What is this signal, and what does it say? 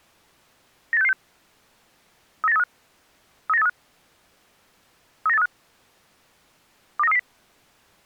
Five-tone selective call (EEA), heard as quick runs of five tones, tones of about 40 ms. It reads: 98666 39835 39835 39835 29330